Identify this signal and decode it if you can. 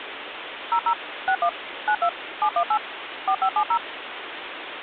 DTMF, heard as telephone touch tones, dialled by machine, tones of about 80 ms, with phone line noise. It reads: 00 61 92 718 4570